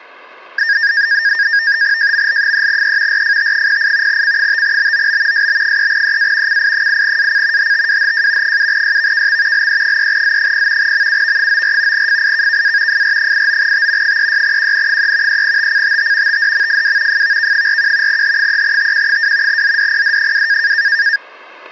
NAVTEX (SITOR-B), 100 baud, 170 Hz shift, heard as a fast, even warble, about 1700 Hz centre, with static crashes. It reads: JML3E RFT08 C5BOB SB3EA CI8AC HTWHJ 7YVKX LE3Z0 MUV94 FIKKA FR89T 36QN3 3TCTT TDMFW FVK41 H3TQ2 ZDPD2